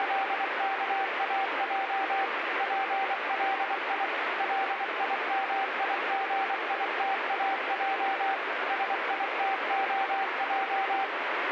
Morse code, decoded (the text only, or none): … PLI LIMIGITAJ SITOJ